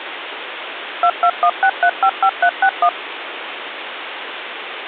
DTMF, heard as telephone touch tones, dialled by machine, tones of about 70 ms, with phone line noise. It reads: 2216355361